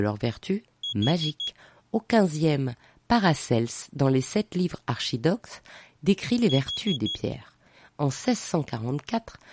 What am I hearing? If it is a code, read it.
Alarm pattern, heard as an alarm's beeps, played twice, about 3350 Hz, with speech in French. Temporal four. Carbon monoxide.